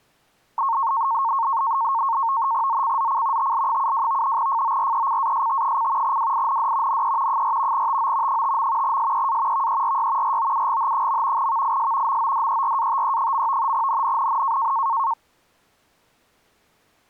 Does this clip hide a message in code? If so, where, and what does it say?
Yes: NAVTEX (SITOR-B), 100 baud, 170 Hz shift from 0.6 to 15.1 s, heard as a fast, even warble, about 1000 Hz centre. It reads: ZCZC TL72 FORECAST: WIND NE 4 TO 5. SEA VERY ROUGH. VIS MODERATE. NNNN